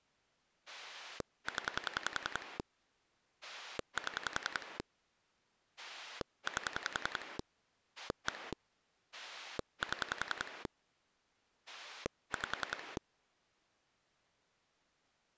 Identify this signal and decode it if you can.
Pulse dialling, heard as a rotary dial, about 10 pulses a second. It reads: 0 7 8 1 7 5